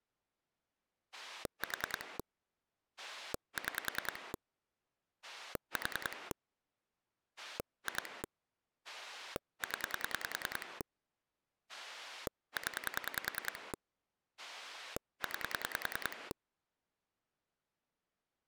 Pulse dialling, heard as a rotary dial, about 10 pulses a second. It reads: 4 6 4 2 0 0 9